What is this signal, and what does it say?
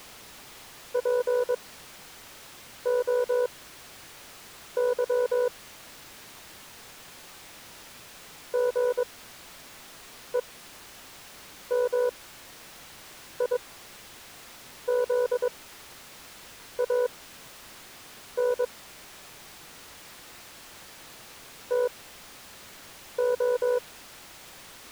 Morse code (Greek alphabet), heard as a keyed tone, machine-sent, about 22 wpm, spaced as for 6 wpm, 490 Hz. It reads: ΠΟΥ ΓΕΜΙΖΑΝ ΤΟ